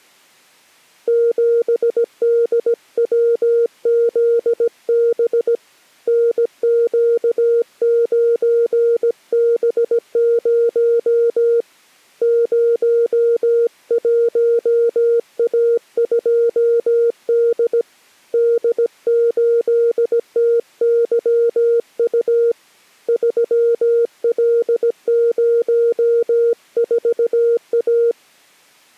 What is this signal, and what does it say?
Morse code, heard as a keyed tone, hand-sent with a paddle, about 17 wpm, 470 Hz. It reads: 7DWZB NQ9B0 01A2D D8TYU 3L04A